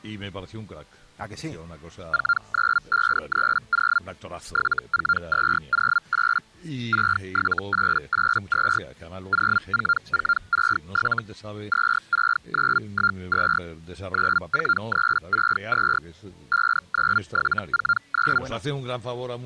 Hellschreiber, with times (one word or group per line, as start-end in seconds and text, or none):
2.1-4.0 49530
4.5-6.4 74208
6.9-8.8 67882
9.3-11.2 04467
11.7-13.6 26912
14.1-16.0 94362
16.5-18.4 59749